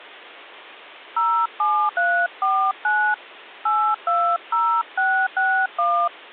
DTMF, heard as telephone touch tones, dialled by hand, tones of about 290 ms. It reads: 07349 820661